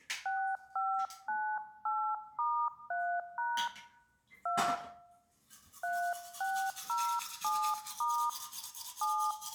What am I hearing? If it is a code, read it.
DTMF, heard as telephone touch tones, dialled by hand, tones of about 300 ms, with room echo and the noise of a restroom. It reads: 6598*3# 2 3607* 7